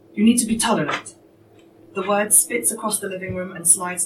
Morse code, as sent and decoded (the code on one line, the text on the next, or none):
none